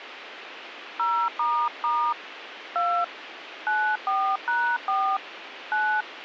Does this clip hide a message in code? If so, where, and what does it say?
Yes: DTMF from 1.0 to 6.0 s, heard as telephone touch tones, dialled by hand, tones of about 290 ms, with radio hiss. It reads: 0** 2 94#4 9